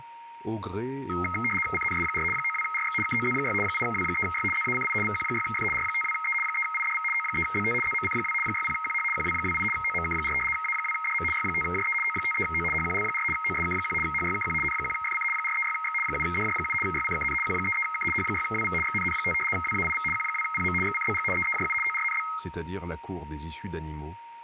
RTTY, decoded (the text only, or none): CNS4 92RX KOZ6 8W3Y ZACI VQ6F R52E 3IDV O3BT ZMC2 60QH QW28 OMK4 A2DM Y5JE O53O HQL4 OSK1 HYKQ N1FC 436X 7DJ7 YCKN Q33K H6WV XNN5 WAIV Q2PM XCBG EEJU ORNB